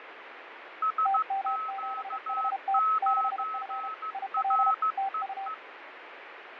Morse code, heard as two keyed tones, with radio static and fading. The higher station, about 15 wpm, 1290 Hz: SQ9REE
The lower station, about 32 wpm, 780 Hz: TM7HT 6F IL TU